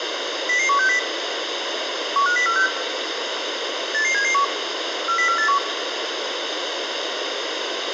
Five-tone selective call (CCIR), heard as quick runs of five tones, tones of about 100 ms, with radio hiss and room echo. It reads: 00160 15046 88771 40481